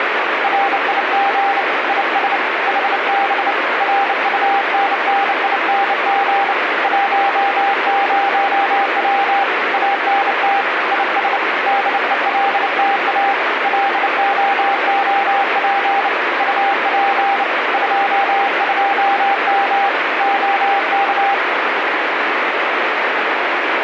Morse code, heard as a keyed tone, hand-sent with a bug key, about 29 wpm, 800 Hz, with radio static. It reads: RIG IS HB RUNNING 10W ANT IS DELTA LOOP UP 22M OK